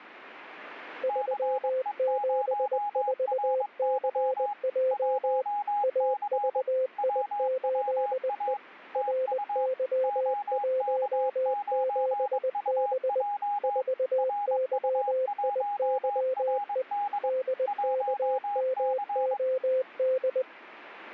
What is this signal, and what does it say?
Morse code, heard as two keyed tones. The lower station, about 20 wpm, 520 Hz: 374CJ AVI8E RY17B 4YIYE DKMOD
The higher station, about 22 wpm, 820 Hz: CE0RY 1C WWA TU OK9UJ RU1RD 1C